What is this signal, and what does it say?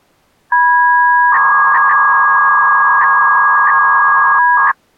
300-baud modem data (V.21 tones), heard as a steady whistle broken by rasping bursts, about 300 baud, 200 Hz shift.